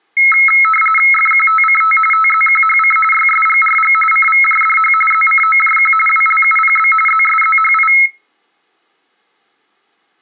RTTY (45.45 baud, 850 Hz shift), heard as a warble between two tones, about 1750 Hz centre. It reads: FQTCT TZQHC YSGRG CVJDH ZCOJQ WLUPB ZSZHI